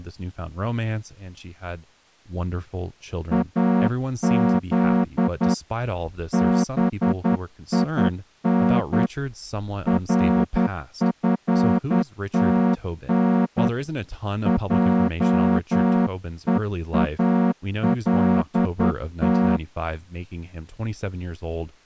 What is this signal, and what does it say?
Morse code (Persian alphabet), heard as a horn, hand-sent with a straight key, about 10 wpm, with speech in English. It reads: از بین رفتن جهالت